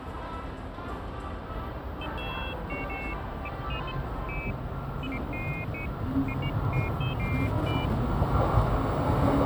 Pairs of high tones at irregular times, with phone line noise and the noise of a subway station. There is no code.